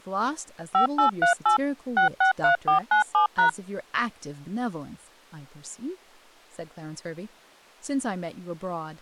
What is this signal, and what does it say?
DTMF, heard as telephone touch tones, dialled by machine, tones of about 110 ms, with speech in English. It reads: 5838 663497#